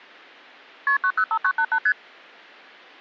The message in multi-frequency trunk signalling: KP 905988 ST

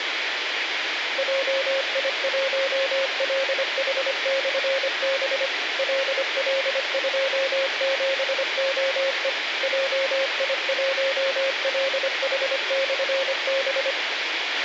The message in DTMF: none

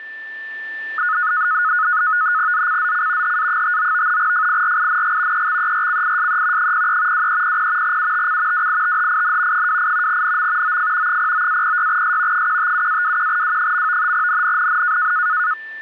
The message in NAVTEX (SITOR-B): ZCZC HA59 FIRING EXERCISE 03 2300 UTC WITHIN 28 NM OF 09-06S 157-21W. NNNN

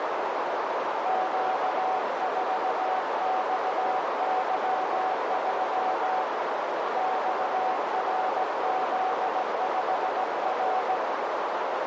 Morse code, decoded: Q4XY3 XRZ5R

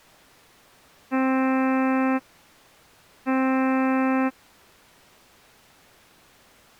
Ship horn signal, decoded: 2 short

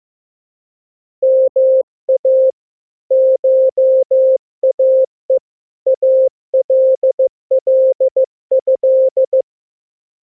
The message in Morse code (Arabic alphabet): ما شاء الله

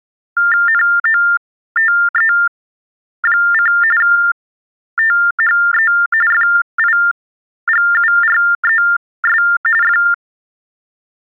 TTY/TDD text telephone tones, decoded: NOTE: THE FIGURES …

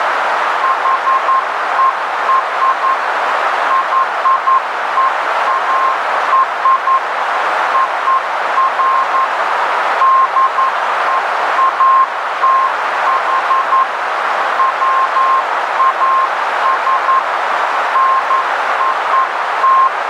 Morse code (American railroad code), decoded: HER YEAR OF DEATH WAS NOT

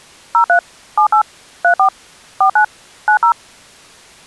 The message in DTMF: 03 78 34 49 90

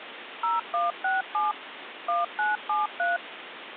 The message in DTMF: 0167 1973

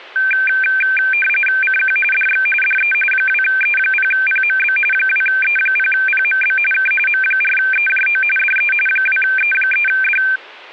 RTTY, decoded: CQ DX DE 2E0PMB 2E0PMB K M4EJO DE 2E3D

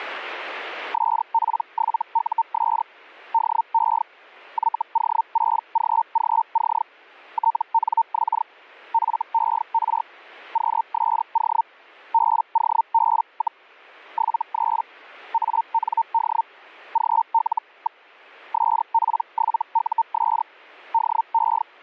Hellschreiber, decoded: SP7US DE YO6GGC TNX FER QSO BOB, 73 AND GL. SP7US DE

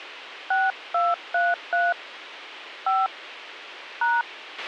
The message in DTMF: 6233 5 #

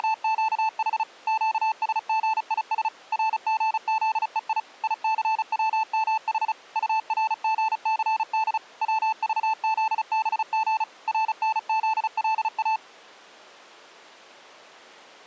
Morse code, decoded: … QSGIS RGZEI ICWMH URGCD WVZBG RNZLA

